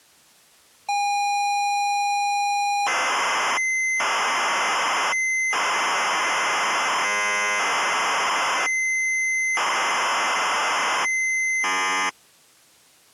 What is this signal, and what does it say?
ZX Spectrum tape loading, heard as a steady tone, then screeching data.